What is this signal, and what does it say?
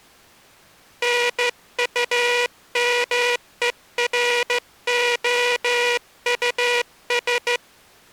Morse code, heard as a buzzer, hand-sent with a straight key, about 14 wpm. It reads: NUMEROUS